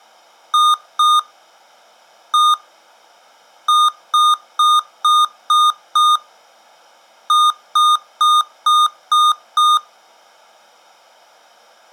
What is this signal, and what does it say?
Beep code, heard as beeps from a small speaker, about 1220 Hz. 2-1-6-6.